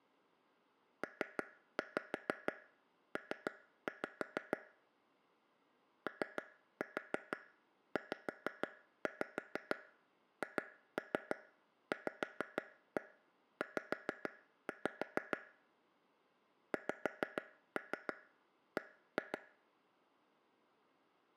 Tap code, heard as taps on a table, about 6 knocks a second, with room echo. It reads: PP OZHVZ XB